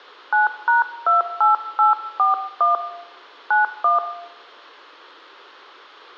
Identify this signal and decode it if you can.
DTMF, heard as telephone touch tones, dialled by hand, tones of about 140 ms, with room echo. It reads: 9#28841 91